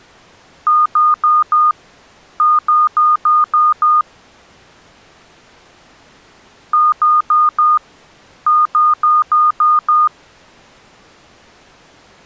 Beep code, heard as beeps, played twice, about 1220 Hz. 4-6.